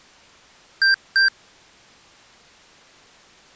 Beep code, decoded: 2 short

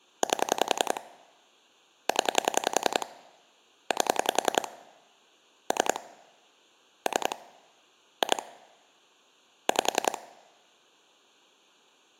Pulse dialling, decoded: 8 0 8 3 3 2 5

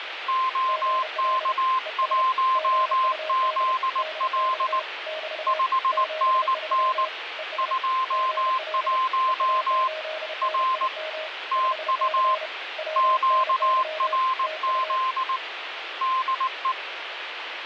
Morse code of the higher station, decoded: OK1ZL 5NN 21 R TU QRZ DE

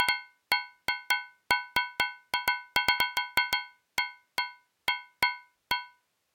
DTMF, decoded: none

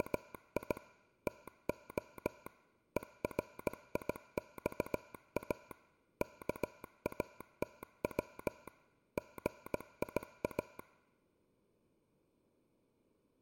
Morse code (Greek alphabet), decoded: … ΤΟ ΕΡΙΞΑ ΚΑΤΩ ΓΙΑ

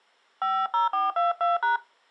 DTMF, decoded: 50422#

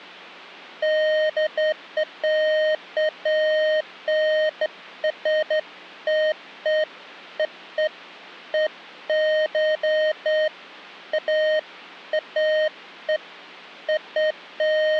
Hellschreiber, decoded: none

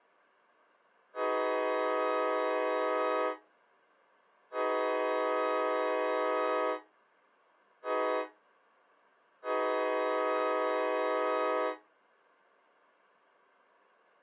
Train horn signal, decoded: 2 long, 1 short, 1 long

